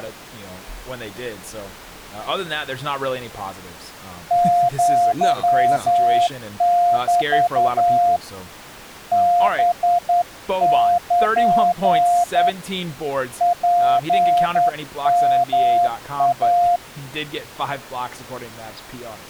Morse code (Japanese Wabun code), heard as a keyed tone, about 10 wpm, 700 Hz, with speech in English. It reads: アメ ハル ツヨイ